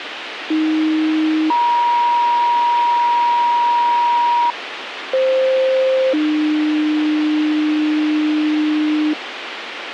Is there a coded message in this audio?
Yes: two-tone page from 0.5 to 9.1 s, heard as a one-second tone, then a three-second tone, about 310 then 950 Hz, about 520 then 300 Hz, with radio hiss.